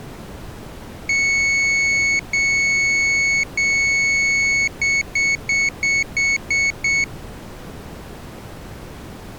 Beep code, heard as a piezo beeper, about 2200 Hz. 3 long, 7 short.